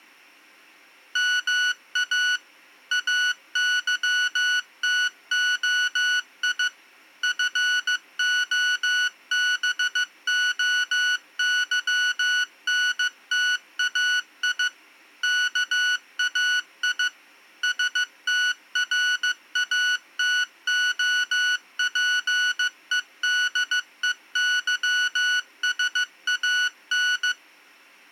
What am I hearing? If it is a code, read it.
Morse code (Greek alphabet), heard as electronic beeps, machine-sent, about 15 wpm, 1480 Hz. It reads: ΜΑ ΑΥΤΟΙ ΦΟΒΟΥΝΤΑΙ ΚΑΙ ΣΤΡΑΤΟΠΕΔΕΥΣΑΝ